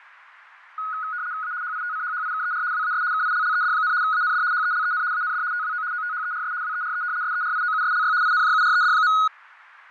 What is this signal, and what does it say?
RTTY (75 baud, 170 Hz shift), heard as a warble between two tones, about 1360 Hz centre, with radio static and fading. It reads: A HITCHHIKER WAS KILLED, AND HELEN AND TWO OTHERS WERE SERIOUSLY INJURED.